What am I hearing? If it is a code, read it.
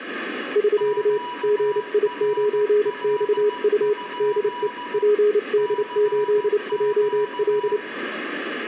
Morse code, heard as two keyed tones, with radio static. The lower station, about 29 wpm, 420 Hz: <SK> GI9XU DE PD8JL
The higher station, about 15 wpm, 980 Hz: QRL? CQ